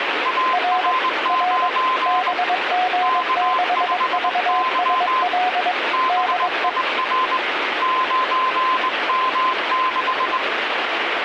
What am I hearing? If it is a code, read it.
Morse code, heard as two keyed tones, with radio static. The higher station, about 21 wpm, 1030 Hz: AR9 K5Y BIR 9M6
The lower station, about 22 wpm, 730 Hz: R R BG6VSL DE